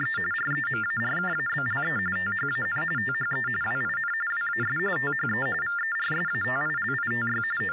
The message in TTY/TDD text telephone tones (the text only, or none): … REMARKABLE THAN THE WIN WAS THE VERSATILITY …